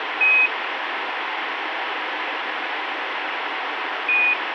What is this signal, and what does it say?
Quindar tones, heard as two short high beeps, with radio hiss.